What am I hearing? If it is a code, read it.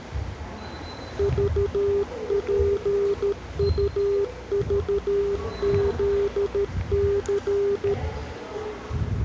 Morse code, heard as a keyed tone, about 13 wpm, 400 Hz, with the noise of a subway station. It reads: VPUVZC